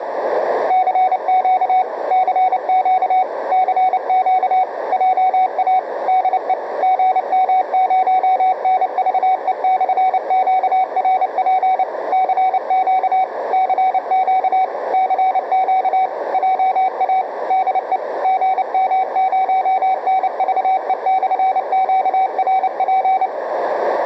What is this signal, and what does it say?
Morse code, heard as a keyed tone, machine-sent, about 29 wpm, 750 Hz, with radio static, a narrow filter and room echo. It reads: CQ CQ CQ JA DE GM0NVE/QRP CQ CQ CQ JA DE GM0NVE/QRP